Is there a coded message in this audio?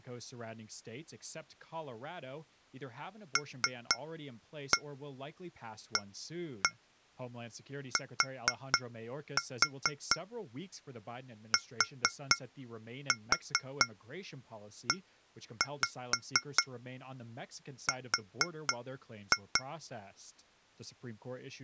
Yes: tap code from 3.4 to 19.7 s, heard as taps on glass, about 4 knocks a second, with speech in English. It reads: LATTER